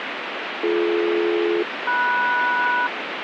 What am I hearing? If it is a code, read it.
Aircraft SELCAL, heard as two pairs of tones, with radio static. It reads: BD-MS